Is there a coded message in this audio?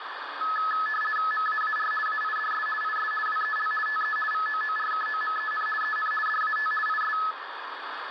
Yes: RTTY (50 baud, 450 Hz shift) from 0.4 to 7.3 s, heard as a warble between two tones, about 1500 Hz centre, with radio static. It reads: MAAR AIDS IS WEL TE VOORKOMEN EN DAT IS